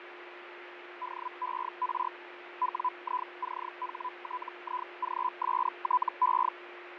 Hellschreiber (Feld-Hell, 122.5 baud), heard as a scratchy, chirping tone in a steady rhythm, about 1000 Hz, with radio static, fading and a steady whistle near 350 Hz. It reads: DER WICHTIGSTE